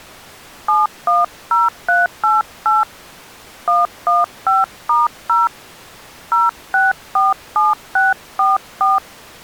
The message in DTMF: 710388 115*0 0647644

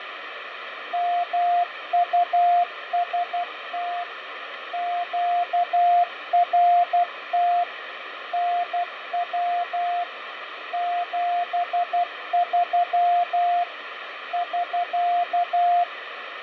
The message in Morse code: MUST QRT NW 73 <SK>

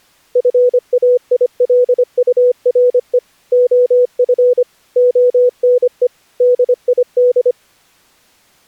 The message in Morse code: FAILURE OF ONE DID

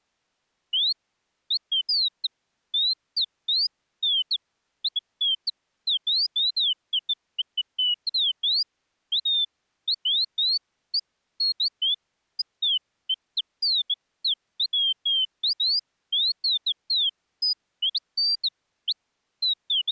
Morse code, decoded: none

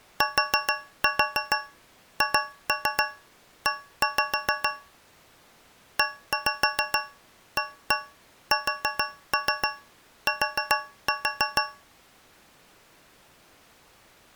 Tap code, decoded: THE EAST

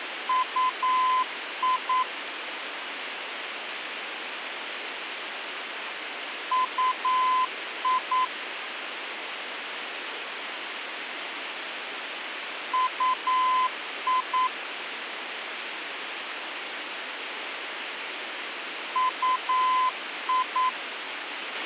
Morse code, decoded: UI UI UI UI

